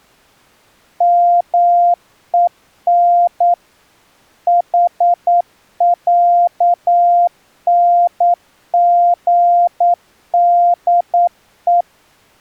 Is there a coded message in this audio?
Yes: Morse code (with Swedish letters) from 0.9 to 11.9 s, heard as a keyed tone, machine-sent, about 9 wpm, 700 Hz. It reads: MEN HÄNGDE